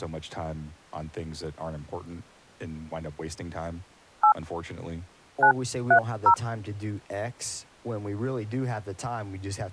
DTMF, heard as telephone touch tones, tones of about 80 ms, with speech in English. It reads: 8 930